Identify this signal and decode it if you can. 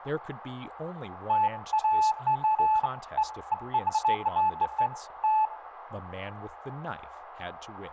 Beeps of irregular length, with radio static, room echo and speech in English. There is no code.